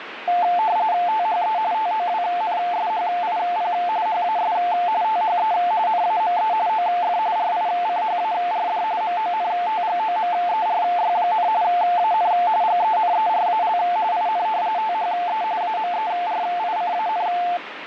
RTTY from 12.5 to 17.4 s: GENERAL IN THE AMERICAN

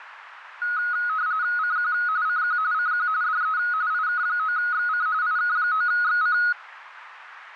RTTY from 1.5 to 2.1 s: CQ

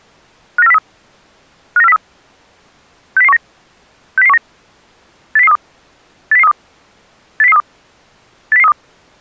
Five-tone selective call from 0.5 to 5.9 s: 59403 59403 60019 60019 80032

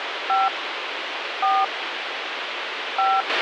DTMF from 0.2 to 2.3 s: 5 4

